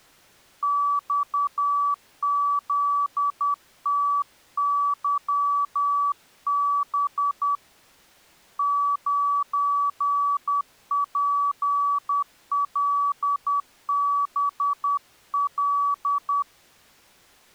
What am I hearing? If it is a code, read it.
Morse code, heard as a keyed tone, hand-sent with a paddle, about 10 wpm, 1150 Hz. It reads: XZTYB 9PLBL